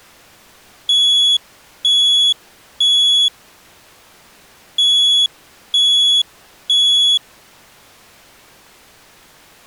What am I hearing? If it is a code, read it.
Alarm pattern, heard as an alarm's beeps, played twice, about 3400 Hz. Temporal three. Smoke or fire, evacuate.